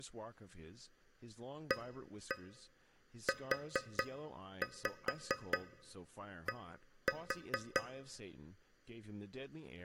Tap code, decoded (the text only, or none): AUD